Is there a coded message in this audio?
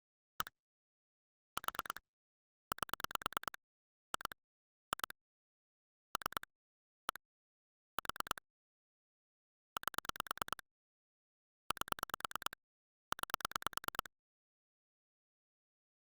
Yes: pulse dialling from 0.4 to 14.1 s, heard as clicks on a phone line, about 9 pulses a second. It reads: 1 4 8 2 2 3 1 4 8 8 9